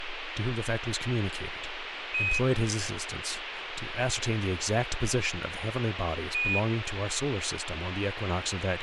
Quindar tones, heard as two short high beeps, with radio hiss and speech in English.